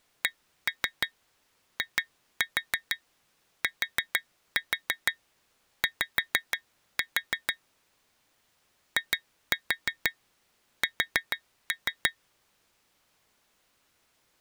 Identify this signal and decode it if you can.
Tap code, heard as taps on glass, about 6 knocks a second. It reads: CITY IS